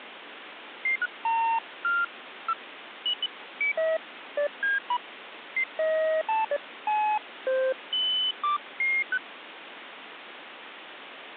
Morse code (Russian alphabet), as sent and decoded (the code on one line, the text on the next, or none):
none